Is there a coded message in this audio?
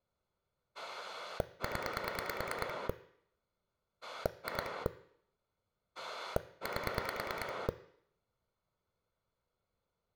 Yes: pulse dialling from 0.7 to 7.7 s, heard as a rotary dial, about 9 pulses a second, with room echo. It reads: 0 2 8